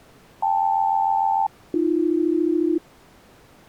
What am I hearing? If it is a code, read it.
Aircraft SELCAL, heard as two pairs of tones. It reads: KL-AB